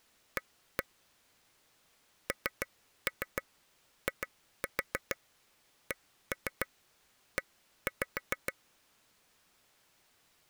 Tap code, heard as taps on a table, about 6 knocks a second. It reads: A NICE